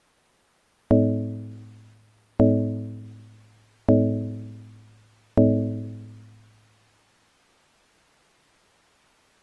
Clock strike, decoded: 4

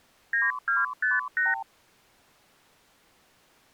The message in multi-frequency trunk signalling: 9258

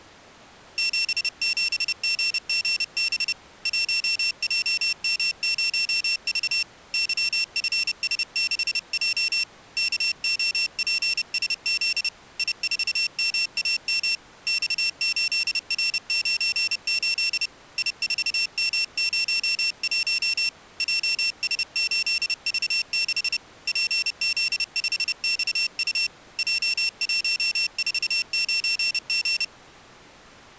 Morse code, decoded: 77GGB 1JM0V YFS6J KOPSZ I4MAM X8R98 I4M01 JS8V6 PZ5XU J149G

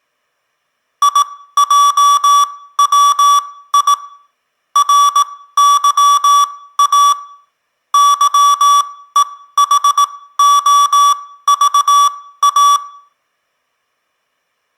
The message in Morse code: IJWI RYA YEHOVA

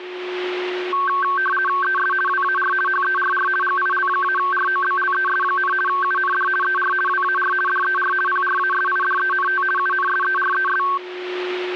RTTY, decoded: ES WAR HERR GIL-ROBLES, UND ER WAR DER PRASIDENT UNSERES

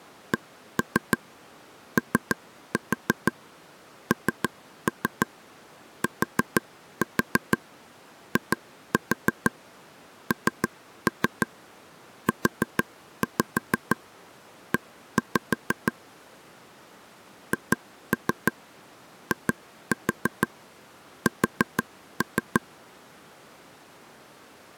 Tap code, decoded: CONTINUE HIS

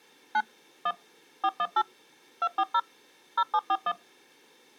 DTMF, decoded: 9 1 418 240 0741

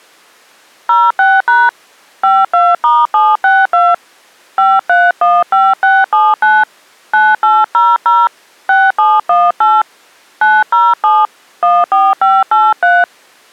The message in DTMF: 06# 52*762 5315679 9800 6718 907 14583

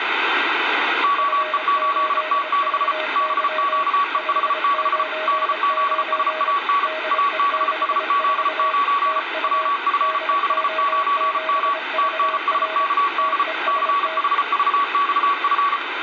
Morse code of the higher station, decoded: OE8T6 BQEH6 DZSAN ABSZ9 WF69M TNSKD CHVXF

